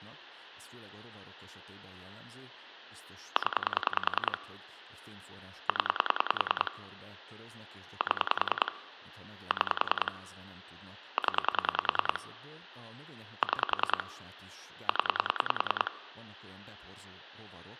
Pulse dialling, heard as clicks on a phone line, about 10 pulses a second, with speech in Hungarian. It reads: 0 0 7 6 0 6 0